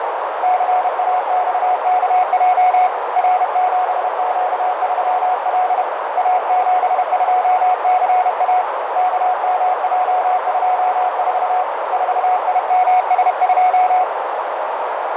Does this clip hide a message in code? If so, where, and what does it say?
Yes: Morse code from 0.4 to 14.1 s, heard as a keyed tone, hand-sent with a paddle, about 31 wpm, 730 Hz, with heavy radio static, fading and a narrow filter. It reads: CAXKJ R7Q3L A72CA KMJ24 4IMS2